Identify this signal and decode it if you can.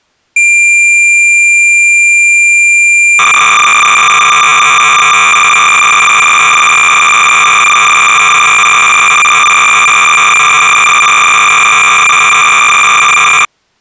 Cassette data (Kansas City type), 300 baud, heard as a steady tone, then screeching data.